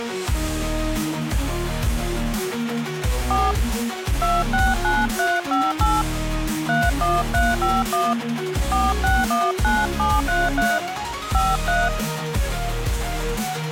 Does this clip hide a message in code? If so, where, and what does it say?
Yes: DTMF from 3.3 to 11.9 s, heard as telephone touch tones, dialled by hand, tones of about 210 ms. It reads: 4 269358 31351 4619733 53